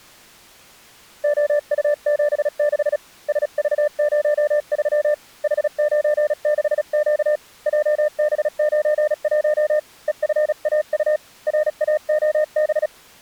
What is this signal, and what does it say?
Morse code, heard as a keyed tone, hand-sent with a paddle, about 36 wpm, 600 Hz. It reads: OU76 SV03 H96Q JB91 EFAU RAOB